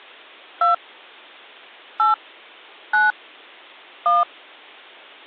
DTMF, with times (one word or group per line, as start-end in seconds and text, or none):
0.6-0.7 2
2.0-2.1 8
2.9-3.1 9
4.1-4.2 1